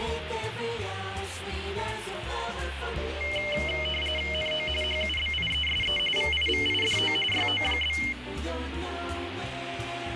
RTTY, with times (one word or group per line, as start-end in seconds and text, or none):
4.3-4.7 NO
4.8-6.0 HUBIESE
6.2-7.2 VIVIDO
7.3-8.0 YO?